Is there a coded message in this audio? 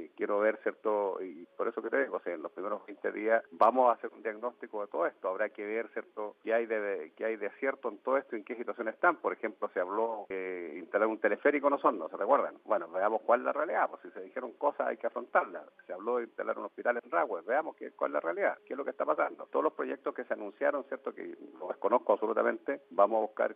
No.